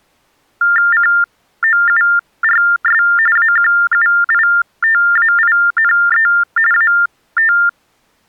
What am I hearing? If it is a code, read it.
TTY/TDD text telephone tones (45.45 baud Baudot), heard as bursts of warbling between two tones, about 400 Hz shift, 1600 Hz centre. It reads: COURS AQUITAINE AT